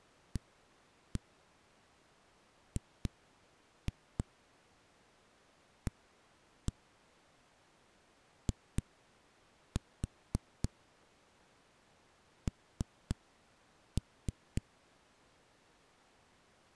Tap code, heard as knocks on a wall, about 3 knocks a second. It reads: AGAIN